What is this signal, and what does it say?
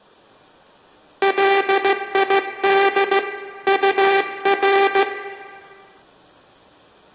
Morse code, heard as a buzzer, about 15 wpm, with room echo. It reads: LID UR